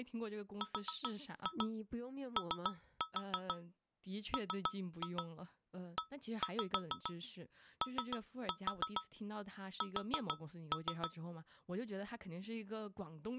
Tap code, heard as taps on a metal pipe, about 6 knocks a second, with speech in Chinese. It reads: ROMEOS